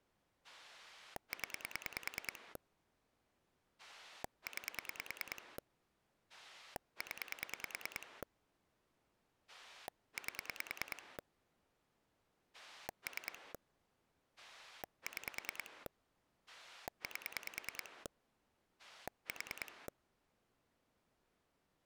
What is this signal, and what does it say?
Pulse dialling, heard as a rotary dial, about 9 pulses a second. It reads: 0 9 0 8 3 6 8 4